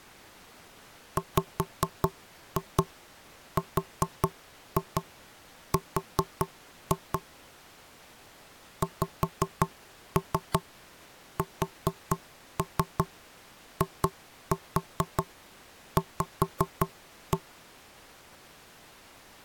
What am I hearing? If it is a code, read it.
Tap code, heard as knocks on wood, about 5 knocks a second. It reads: WRR XSIV